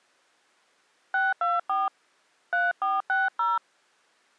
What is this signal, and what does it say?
DTMF, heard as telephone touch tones, dialled by hand, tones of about 190 ms. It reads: 624 3460